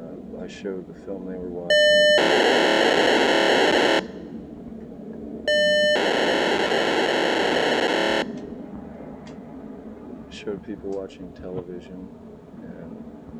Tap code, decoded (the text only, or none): none